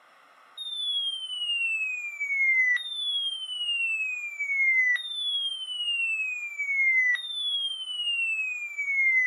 A tone that sweeps in pitch again and again. There is no code.